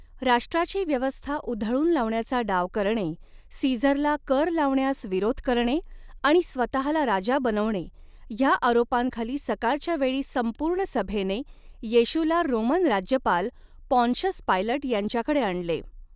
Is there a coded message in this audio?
No, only speech in Marathi.